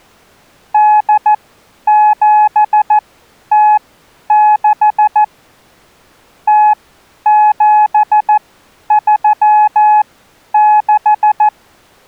Morse code (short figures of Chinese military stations), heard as a keyed tone, machine-sent, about 14 wpm, spaced as for 10 wpm, 850 Hz. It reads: 8706 0736